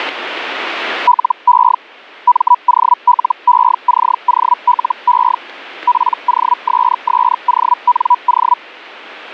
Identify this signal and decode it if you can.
Hellschreiber (Feld-Hell, 122.5 baud), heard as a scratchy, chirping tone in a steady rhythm, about 980 Hz. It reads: LE MOLECOLE POSSONO